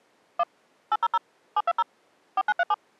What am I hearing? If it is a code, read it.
DTMF, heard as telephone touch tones, dialled by machine, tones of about 40 ms. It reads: 1 800 720 4937